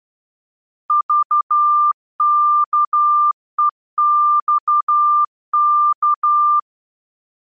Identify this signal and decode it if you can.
Morse code, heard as a keyed tone, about 12 wpm, 1190 Hz. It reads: VKEXK